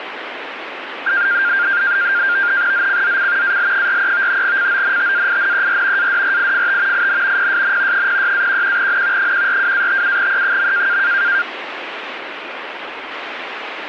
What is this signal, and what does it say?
NAVTEX (SITOR-B), 100 baud, 170 Hz shift, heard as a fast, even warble, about 1500 Hz centre, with radio static. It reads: ZCZC AL43 CONTAINER ADRIFT IN PSN 06-11N 142-57E.